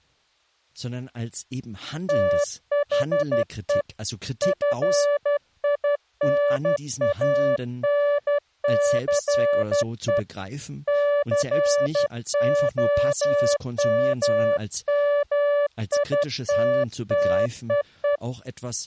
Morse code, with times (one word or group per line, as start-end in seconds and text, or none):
2.1-3.8 THE
4.4-10.2 FINANCE
10.9-18.2 COMMITTEE